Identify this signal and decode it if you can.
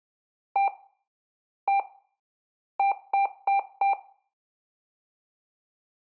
Beep code, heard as beeps, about 790 Hz, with room echo. 1-1-4. In Phoenix BIOS tables: BIOS ROM checksum failure.